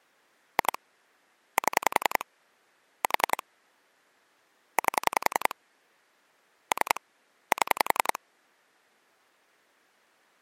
Pulse dialling, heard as clicks on a phone line, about 10 pulses a second. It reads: 2 7 4 8 3 7